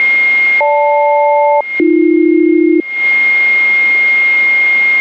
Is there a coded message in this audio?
Yes: aircraft SELCAL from 0.6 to 2.8 s, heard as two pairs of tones, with a steady whistle near 2130 Hz. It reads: GL-AB